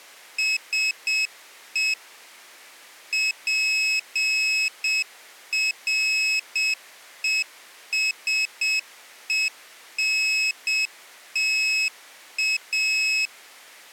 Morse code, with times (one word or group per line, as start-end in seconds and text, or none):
0.4-1.9 SE
3.1-13.3 PRESENTA